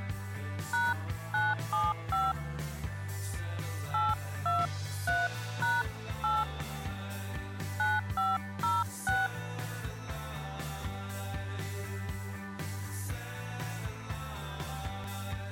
DTMF, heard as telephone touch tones, dialled by hand, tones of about 200 ms. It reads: #975 823#8 9506